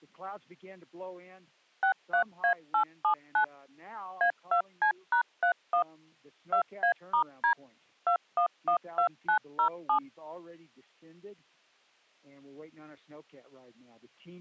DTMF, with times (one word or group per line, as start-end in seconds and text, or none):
1.8-3.4 63A879
4.2-5.8 A2C#31
6.5-7.5 2A*D
8.1-10.0 2112907